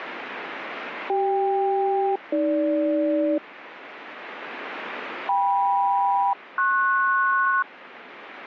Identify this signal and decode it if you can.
Aircraft SELCAL, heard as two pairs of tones, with radio static. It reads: CK-AG KM-PS